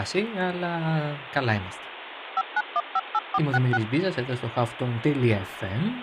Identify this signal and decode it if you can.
DTMF, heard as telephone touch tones, dialled by machine, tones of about 40 ms, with phone line noise and speech in Greek. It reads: 59158466